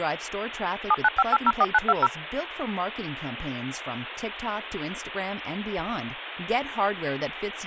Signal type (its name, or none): DTMF